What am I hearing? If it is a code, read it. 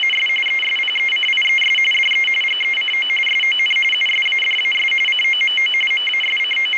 RTTY (45.45 baud, 850 Hz shift), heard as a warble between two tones, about 2550 Hz centre, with radio static. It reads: … ESPECIES DE GECO SON USADAS COMO …